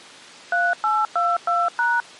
DTMF, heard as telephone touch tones, dialled by machine, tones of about 210 ms. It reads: 3822#